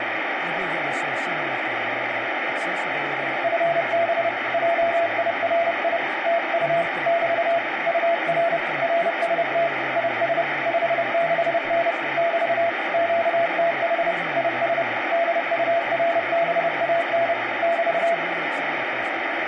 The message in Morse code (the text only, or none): FB JIRI TU <BT> UR RST IS 56N <BT> QTH IS DURBAN <BT>